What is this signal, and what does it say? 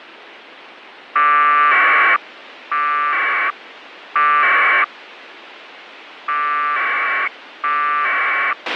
Packet radio (AX.25, as in APRS), 1200 baud, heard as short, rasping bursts, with radio hiss and a squelch burst at the end.